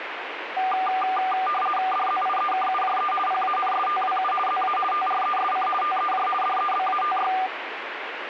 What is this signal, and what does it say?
RTTY (50 baud, 450 Hz shift), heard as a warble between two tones, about 980 Hz centre, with radio static. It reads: DZIEKUJE PANSTWU ZA TRESC TEJ DEBATY